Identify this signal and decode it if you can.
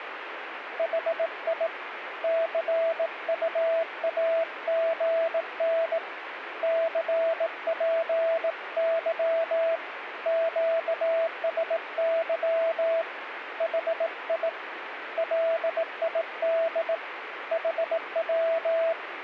Morse code, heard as a keyed tone, hand-sent with a bug key, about 18 wpm, 660 Hz, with radio static. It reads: HI CUAGN CPY QSY HI LID HW